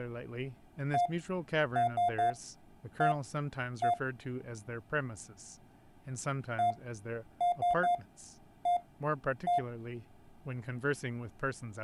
Beep code, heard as beeps from a small speaker, played twice, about 700 Hz, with room echo and speech in English. 1-3-1-1. In Phoenix BIOS tables: memory refresh test failure.